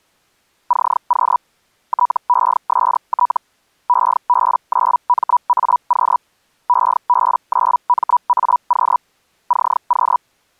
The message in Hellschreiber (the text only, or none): CQ TEST EB9MAQ EB9MAQ CQ